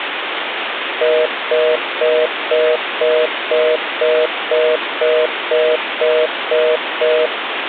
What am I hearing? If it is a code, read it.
Telephone call progress tone (North American plan), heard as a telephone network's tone, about 480, 620 Hz, 0.25 s on and 0.25 s off, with phone line noise. Congestion tone.